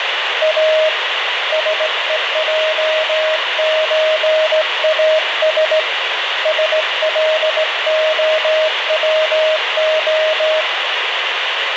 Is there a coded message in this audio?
Yes: Morse code (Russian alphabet) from 0.4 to 10.7 s, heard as a keyed tone, hand-sent with a straight key, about 17 wpm, 630 Hz, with radio static. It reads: А СЕЙЧАС СЛОВО